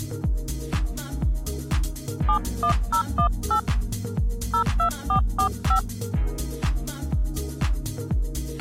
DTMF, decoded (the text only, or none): 71018 02445